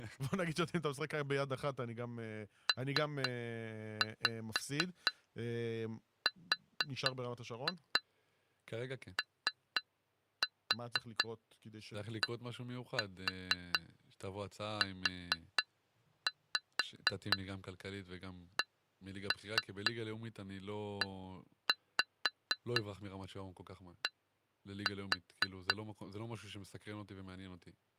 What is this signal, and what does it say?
Tap code, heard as taps on glass, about 4 knocks a second, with speech in Hebrew. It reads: PRODUCED